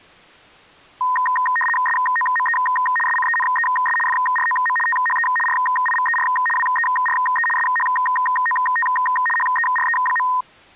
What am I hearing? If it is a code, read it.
RTTY (75 baud, 850 Hz shift), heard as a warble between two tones, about 1430 Hz centre. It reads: SOME SCENES FROM THE RIVER WERE SHOT HERE.